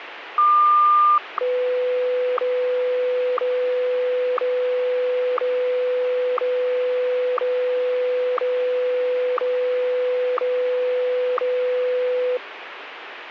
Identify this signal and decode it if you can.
Radio time signal (WWVH, Hawaii), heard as ticks, one a second, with radio static.